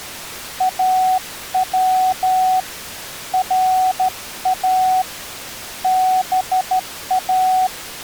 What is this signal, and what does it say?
Morse code (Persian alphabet), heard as a keyed tone, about 13 wpm, 750 Hz. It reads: او را با